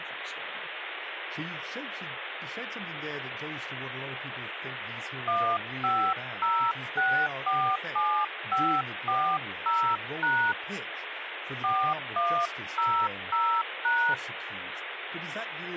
DTMF, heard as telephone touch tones, dialled by hand, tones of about 300 ms, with phone line noise and speech in English. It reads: 150647540# 4100#